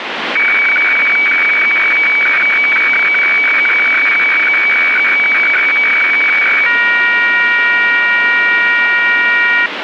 Weather fax (radiofax), 120 lines a minute, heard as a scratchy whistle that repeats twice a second, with radio static.